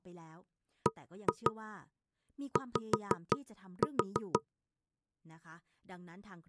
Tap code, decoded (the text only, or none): BY